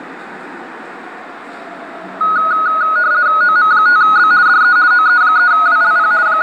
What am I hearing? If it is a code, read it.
RTTY (50 baud, 170 Hz shift), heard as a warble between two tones, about 1360 Hz centre, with the noise of a subway station. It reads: OM5B DE OE3WLP …